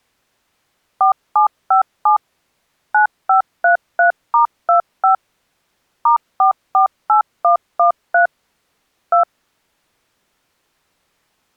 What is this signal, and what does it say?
DTMF, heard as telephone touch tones, dialled by machine, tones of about 110 ms. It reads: 4757 9533*25 *448113 2